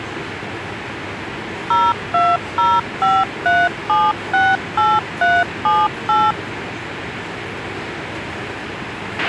DTMF, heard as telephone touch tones, dialled by machine, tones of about 220 ms, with a squelch burst at the end and the noise of a subway station. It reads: 02053768378